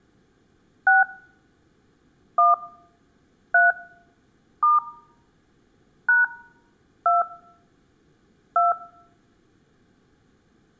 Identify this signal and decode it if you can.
DTMF, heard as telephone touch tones, dialled by hand, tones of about 160 ms. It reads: 6 1 3 * # 2 2